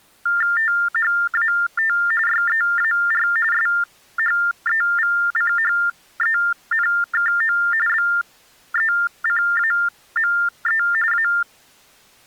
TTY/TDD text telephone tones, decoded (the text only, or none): THAT YEAR SHEVCHENKO BECAME A